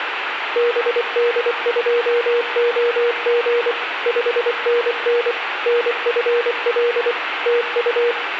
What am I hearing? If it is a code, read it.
Morse code, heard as a keyed tone, machine-sent, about 24 wpm, 480 Hz, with radio static and room echo. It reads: BD2OG 5NN NFL TU